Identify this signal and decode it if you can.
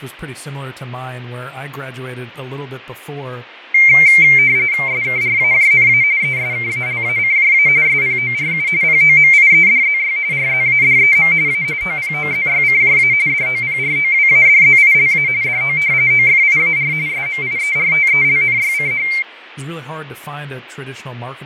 RTTY (45.45 baud, 170 Hz shift), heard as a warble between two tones, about 2200 Hz centre, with radio static, fading and speech in English. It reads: SKRAJNA ESKALACJA SPORU POMIEDZY RZADEM A OPOZYCJA DOPROWADZILA DO OFIAR SMIERTELNYCH